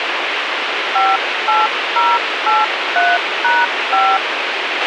DTMF, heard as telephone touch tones, dialled by hand, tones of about 220 ms, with radio hiss and a squelch burst at the end. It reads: 58083#5